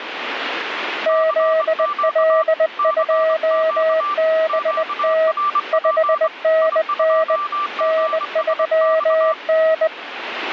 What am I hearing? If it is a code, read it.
Morse code, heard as two keyed tones, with radio static. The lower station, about 20 wpm, 640 Hz: ZL2BT 5NN N3N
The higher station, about 23 wpm, 1180 Hz: CQ CQ QRP I2GSX